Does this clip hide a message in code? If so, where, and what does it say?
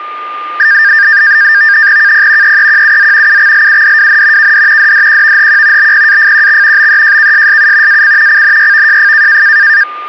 Yes: NAVTEX (SITOR-B), 100 baud, 170 Hz shift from 0.6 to 9.8 s, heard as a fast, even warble, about 1700 Hz centre, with a steady whistle near 1210 Hz. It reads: KP EEQUZ UXLUDWN KD DDQVHQ BPAFQX BEJKSSU AC CNYVJF